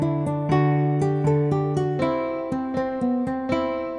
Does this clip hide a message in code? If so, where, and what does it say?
No.